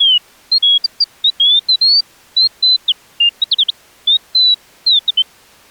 Bird-like chirps. There is no code.